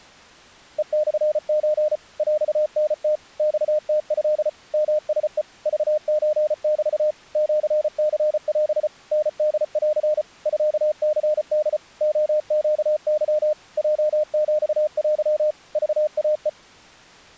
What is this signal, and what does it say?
Morse code (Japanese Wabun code), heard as a keyed tone, machine-sent, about 34 wpm, 610 Hz. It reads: ヘモソ ヰタム マムト ヨラヘ クソメ シニオ タホン ミニホ レネケ ヲヒテ クイヘ